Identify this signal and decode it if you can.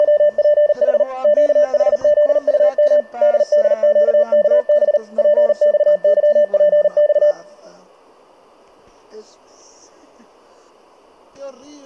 Morse code, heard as a keyed tone, machine-sent, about 39 wpm, 590 Hz. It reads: … QHZUM DDQKB PXYPX